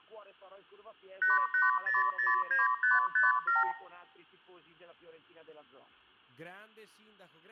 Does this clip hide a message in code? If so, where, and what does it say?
Yes: multi-frequency trunk signalling (R2, with the far end's replies) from 1.2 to 3.7 s, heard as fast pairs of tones, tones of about 160 ms. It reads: 88009557